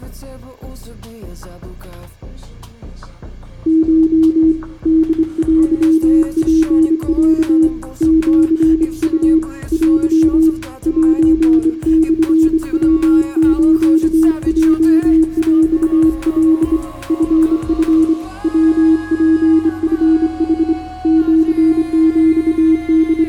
Morse code (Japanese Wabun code), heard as a keyed tone, hand-sent with a straight key, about 25 wpm, 320 Hz, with room echo. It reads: コ ホテツロ シウ テ セモヤスヲヰカ チチ ヤツチヌ …